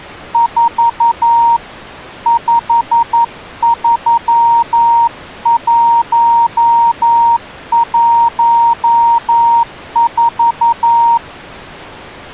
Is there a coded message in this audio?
Yes: Morse code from 0.3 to 11.2 s, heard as a keyed tone, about 11 wpm, 930 Hz. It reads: 4 53114